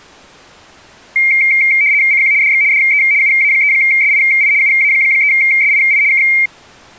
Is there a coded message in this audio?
Yes: RTTY (75 baud, 170 Hz shift) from 1.2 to 6.5 s, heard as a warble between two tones, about 2200 Hz centre. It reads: CQ DX DE UA3SII UA3SII K